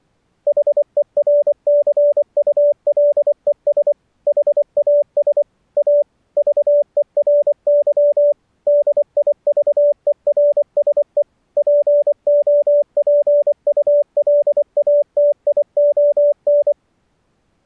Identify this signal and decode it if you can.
Morse code, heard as a keyed tone, machine-sent, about 24 wpm, 580 Hz. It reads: HERCULES HAS A VERY DIVERSE POPULATION